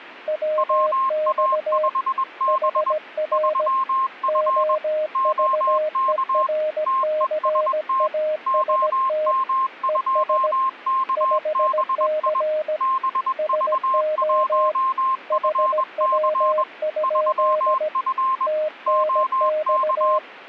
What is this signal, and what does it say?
Morse code, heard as two keyed tones. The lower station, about 17 wpm, 620 Hz: WX HR OVERCAST ES 5C SO HW? TNX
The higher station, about 21 wpm, 1060 Hz: WA5B 3F OK TEST OM2KBI BV1FC 3F OK